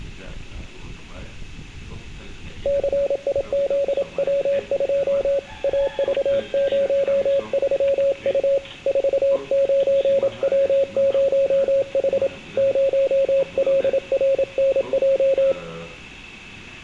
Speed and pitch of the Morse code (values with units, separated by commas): 27 wpm, 550 Hz